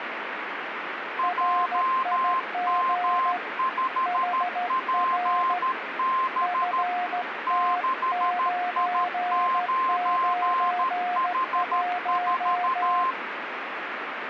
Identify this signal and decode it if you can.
Morse code, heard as two keyed tones, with radio static. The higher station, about 13 wpm, 1050 Hz: JM5PB 6I9H4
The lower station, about 14 wpm, 720 Hz: RIG HR FT991